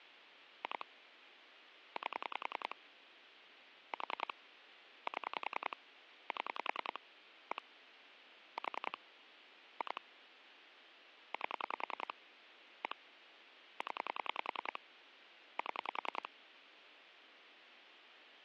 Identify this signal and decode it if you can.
Pulse dialling, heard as clicks on a phone line, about 10 pulses a second, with phone line noise. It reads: 2 8 4 7 7 1 4 2 8 1 0 7